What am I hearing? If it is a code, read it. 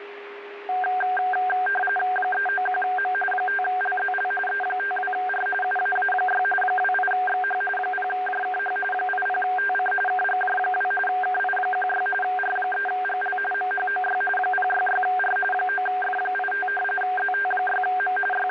RTTY (45.45 baud, 850 Hz shift), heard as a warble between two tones, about 1160 Hz centre, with radio static and a steady whistle near 410 Hz. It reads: 391M 5LZL E52R UAA6 28XH 0JKH 80TC KGJ2 KI16 R3GL MHOY 066R 9F85 ZT6M …